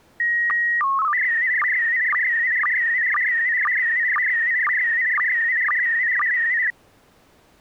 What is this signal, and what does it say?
SSTV (slow-scan television), PD 120, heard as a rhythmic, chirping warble.